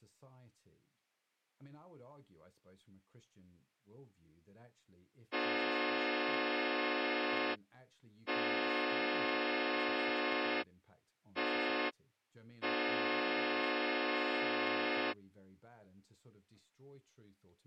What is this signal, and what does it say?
Train horn signal, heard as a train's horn, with speech in English. 2 long, 1 short, 1 long. On North American railways: approaching a public crossing.